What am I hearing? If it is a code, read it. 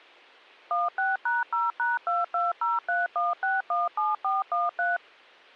DTMF, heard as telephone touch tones, dialled by machine, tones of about 180 ms. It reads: 16#0#22031617413